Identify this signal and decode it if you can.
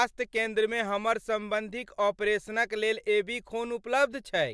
Speech in Maithili. There is no code.